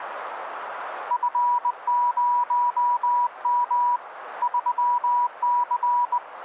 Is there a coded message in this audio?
Yes: Morse code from 1.0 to 6.2 s, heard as a keyed tone, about 20 wpm, 970 Hz, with radio static. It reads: F0M 3C